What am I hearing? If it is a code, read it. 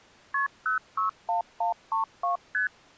Multi-frequency trunk signalling (R1, as on North American trunks), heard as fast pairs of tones, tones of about 120 ms. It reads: KP 061132 ST